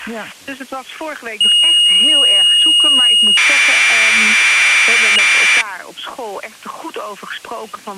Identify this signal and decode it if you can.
Commodore tape loading (standard loader), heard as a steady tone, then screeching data.